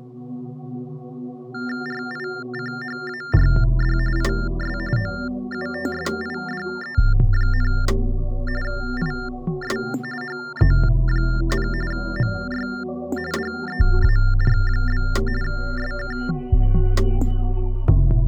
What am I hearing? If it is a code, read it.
TTY/TDD text telephone tones (45.45 baud Baudot), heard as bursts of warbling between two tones, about 400 Hz shift, 1600 Hz centre. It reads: RICHARD IS OUTSIDE, IS HE, MY DEAR? SK